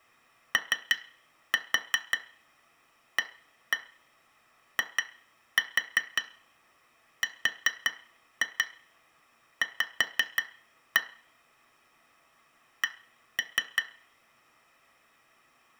Tap code, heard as taps on glass, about 5 knocks a second, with room echo. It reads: OAIRV C